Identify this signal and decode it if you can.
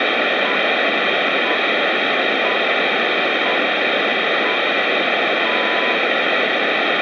Radio time signal (six pips, as the Greenwich Time Signal), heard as pips, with radio static and room echo.